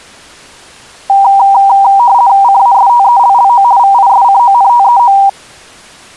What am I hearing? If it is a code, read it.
RTTY (50 baud, 170 Hz shift), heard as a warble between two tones, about 870 Hz centre. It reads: CASTELLO VISCONTEO